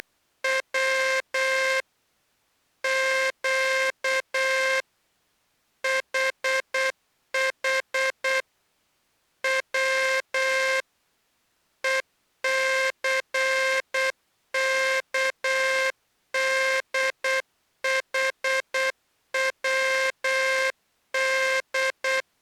Morse code, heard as a buzzer, machine-sent, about 8 wpm. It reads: … Q HH W ECKDHWD